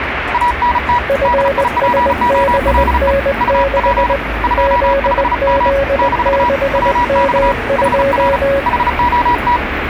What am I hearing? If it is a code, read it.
Morse code, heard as two keyed tones, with radio static and street noise. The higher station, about 35 wpm, 970 Hz: ANT DIPOLE UP 25M - WX HR HOT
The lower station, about 20 wpm, 550 Hz: FSBN6 ZZ6M2